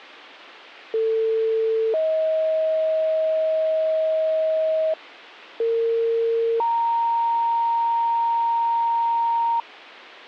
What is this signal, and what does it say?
Two-tone page, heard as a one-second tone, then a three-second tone, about 450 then 630 Hz, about 460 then 930 Hz.